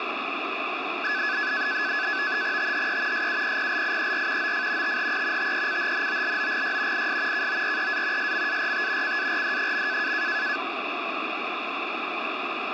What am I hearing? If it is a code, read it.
NAVTEX (SITOR-B), 100 baud, 170 Hz shift, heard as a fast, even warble, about 1600 Hz centre, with radio static. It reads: THE SUPPLIER OF THE TECHNOLOGY IS KOREA SMART CARD.